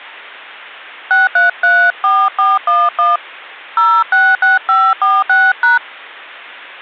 DTMF, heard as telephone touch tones, dialled by hand, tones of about 220 ms. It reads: 6334411 066546#